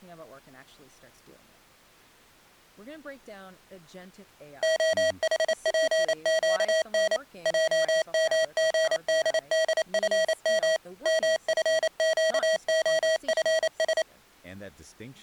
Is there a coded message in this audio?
Yes: Morse code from 4.6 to 14.1 s, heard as electronic beeps, machine-sent, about 28 wpm, 640 Hz. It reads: OHPQN JMGDDFM MFQOFS